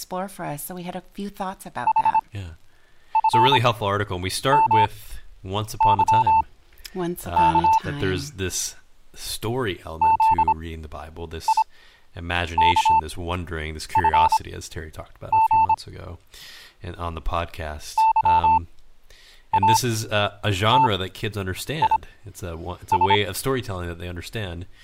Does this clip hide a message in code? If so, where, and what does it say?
Yes: Morse code (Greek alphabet) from 1.8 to 23.2 s, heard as a keyed tone, machine-sent, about 26 wpm, spaced as for 8 wpm, 890 Hz, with speech in English. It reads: ΗΦΜΥΚ ΖΙΚΦΓ ΥΑΤΙΣ